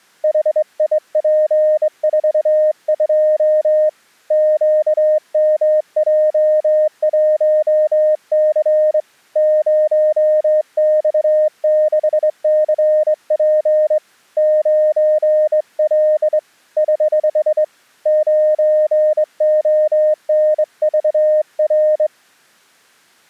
Morse code, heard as a keyed tone, hand-sent with a straight key, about 22 wpm, 610 Hz. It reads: HIP42 QMJ1C 0X6CP 9L <HH> 9ONVR